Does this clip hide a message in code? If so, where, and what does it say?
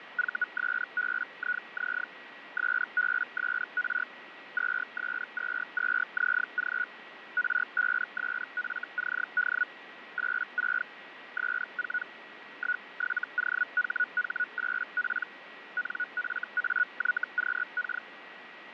Yes: Hellschreiber (Feld-Hell, 122.5 baud) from 0.2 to 18.0 s, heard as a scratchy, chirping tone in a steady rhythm, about 1460 Hz, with radio static and a steady whistle near 1920 Hz. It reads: VSBIZ SBSR 2S22ZG R5SFCD 86 S4 17OHH8P NFAYQK